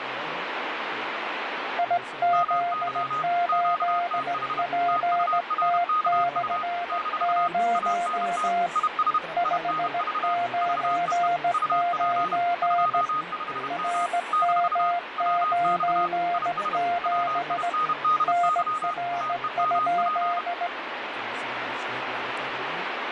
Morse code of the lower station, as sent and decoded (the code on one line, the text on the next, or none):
.. --.. ---.. .--. - -..-. ----- / ..... ----. ----. / .-. -- ----. --... / -. .-. ..--..
IZ8PT/0 599 RM97 NR?